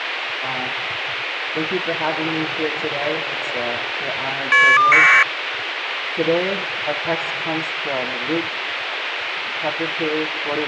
Caller ID data burst, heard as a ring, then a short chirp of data, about 1200 baud, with phone line noise.